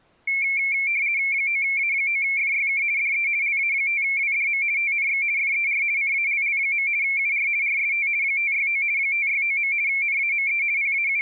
RTTY (50 baud, 170 Hz shift), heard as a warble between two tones, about 2250 Hz centre. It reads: 9A9FYK DE LA5WDM TNX FER CALL. UR RST 569 569. NAME …